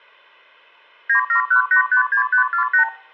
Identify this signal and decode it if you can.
Multi-frequency trunk signalling (R2, with the far end's replies), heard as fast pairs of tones, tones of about 100 ms. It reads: 971856548